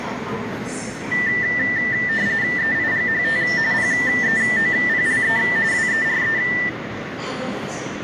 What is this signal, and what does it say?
RTTY (45.45 baud, 170 Hz shift), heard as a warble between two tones, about 1900 Hz centre, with radio static, a narrow filter and the noise of a subway station. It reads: EIGHT PEOPLE WERE